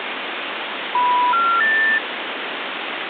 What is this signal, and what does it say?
Telephone call progress tone (North American plan), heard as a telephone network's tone, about 980, 1370, 1800 Hz, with phone line noise. Special information tone.